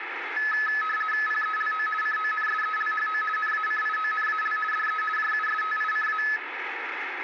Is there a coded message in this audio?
Yes: RTTY (50 baud, 450 Hz shift) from 0.4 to 6.4 s, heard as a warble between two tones, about 1500 Hz centre, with radio static and room echo. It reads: PELO CONSELHO NACIONAL DE JUSTICA